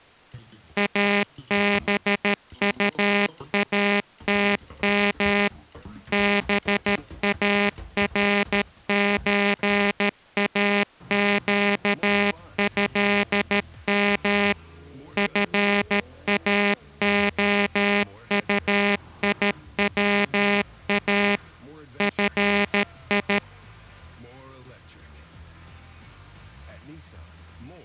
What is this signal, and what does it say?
Morse code (Arabic alphabet), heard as a buzzer, machine-sent, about 13 wpm. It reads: ابطاتم بارزاقهم فاخطيوا في